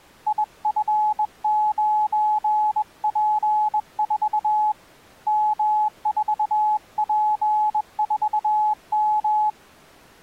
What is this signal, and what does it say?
Morse code, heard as a keyed tone, hand-sent with a bug key, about 21 wpm, 850 Hz. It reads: IF9P4 M4P4M